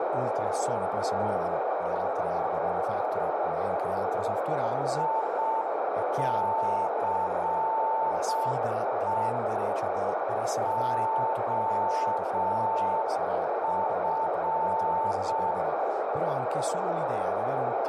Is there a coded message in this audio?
Yes: Morse code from 4.9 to 15.6 s, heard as a keyed tone, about 6 wpm, 890 Hz, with heavy radio static, a narrow filter and speech in Italian. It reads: ICE OF